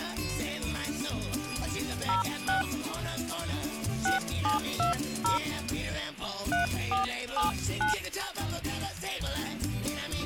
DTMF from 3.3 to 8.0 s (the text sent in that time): 6720 3479